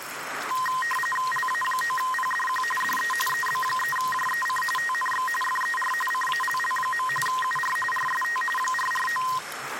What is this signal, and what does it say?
RTTY (45.45 baud, 850 Hz shift), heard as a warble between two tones, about 1450 Hz centre, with radio static and the noise of a restroom. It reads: LA9PDQ DE EB3JEC TNX FER CALL. UR RST 449